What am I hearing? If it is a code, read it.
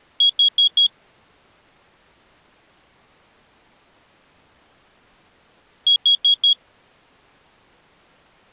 Alarm pattern, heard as an alarm's beeps, played twice, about 3300 Hz. Temporal four. Carbon monoxide.